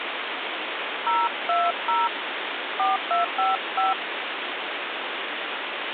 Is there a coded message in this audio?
Yes: DTMF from 1.1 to 3.9 s, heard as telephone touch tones, dialled by hand, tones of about 170 ms, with phone line noise. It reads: 020 4255